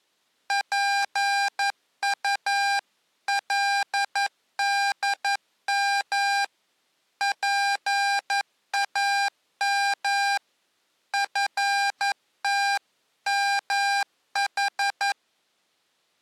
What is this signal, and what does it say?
Morse code (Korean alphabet), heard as electronic beeps, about 11 wpm, 800 Hz. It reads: 지금 좀 너무